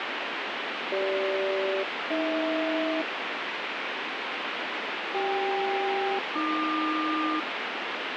Aircraft SELCAL, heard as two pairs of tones, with heavy radio static. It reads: CG-AH CK-AQ